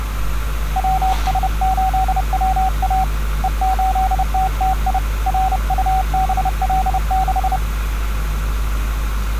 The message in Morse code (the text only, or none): WS8WA E8TTI RUBL6